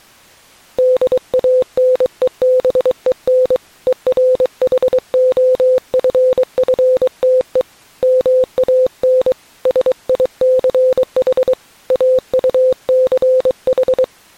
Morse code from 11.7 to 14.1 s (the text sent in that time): AUCH